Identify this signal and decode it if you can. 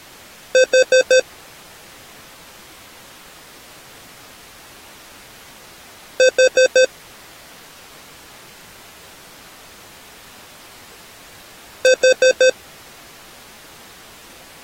Alarm pattern, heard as an alarm's beeps, played three times, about 520 Hz. Temporal four. Carbon monoxide.